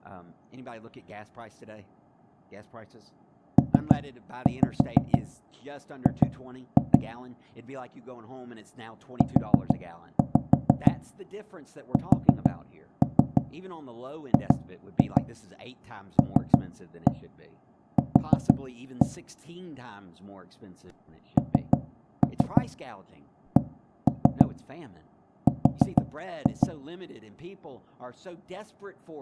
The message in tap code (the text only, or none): PG USGLQ NCR